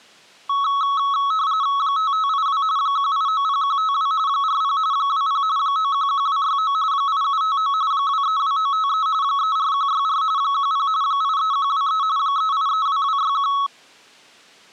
RTTY (45.45 baud, 170 Hz shift), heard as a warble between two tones, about 1200 Hz centre. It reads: 5582 1890152 40 20 911269 8759 232953 34164 10 83123 3832261